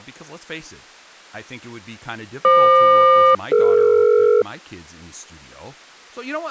Aircraft SELCAL, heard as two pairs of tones, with speech in English. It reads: FQ-DE